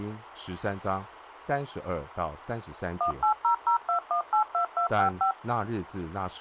DTMF, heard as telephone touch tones, dialled by machine, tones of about 100 ms, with phone line noise and speech in Chinese. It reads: 18002182255